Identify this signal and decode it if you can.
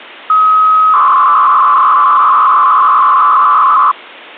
300-baud modem data (Bell 103 tones), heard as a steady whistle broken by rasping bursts, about 300 baud, 200 Hz shift.